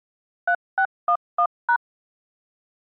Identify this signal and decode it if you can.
DTMF, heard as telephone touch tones, dialled by machine, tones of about 80 ms. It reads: 3611#